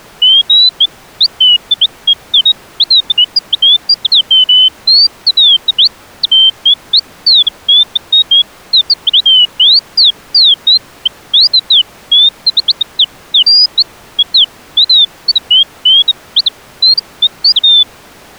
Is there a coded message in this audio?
No, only bird-like chirps.